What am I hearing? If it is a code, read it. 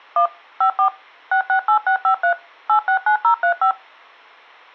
DTMF, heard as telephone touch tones, dialled by machine, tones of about 100 ms. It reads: 1 54 668653 869035